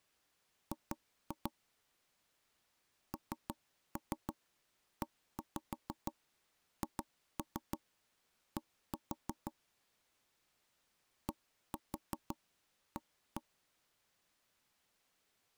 Tap code, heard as knocks on wood, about 6 knocks a second. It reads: G NEHD DA